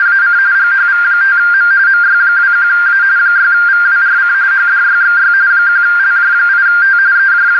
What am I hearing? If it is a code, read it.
RTTY (45.45 baud, 170 Hz shift), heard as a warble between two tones, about 1500 Hz centre, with radio static and a narrow filter. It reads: … GHV5M MY21A 6VWRC HDYXY 1LJ8T …